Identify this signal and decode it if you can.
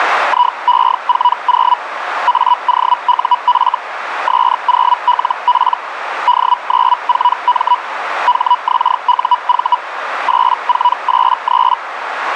Hellschreiber (Feld-Hell, 122.5 baud), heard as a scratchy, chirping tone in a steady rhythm, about 980 Hz, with radio static and a narrow filter. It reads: IE40 AOUF S0LP D94M HXUV 8483